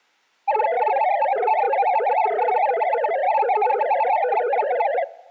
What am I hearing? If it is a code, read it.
Multi-tone FSK (Olivia or MFSK type), about 500 Hz wide, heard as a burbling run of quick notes, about 62.5 baud.